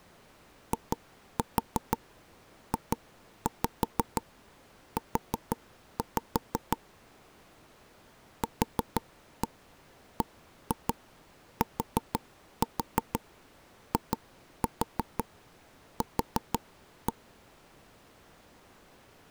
Tap code, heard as taps on a table, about 6 knocks a second. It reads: IJU QBTIQ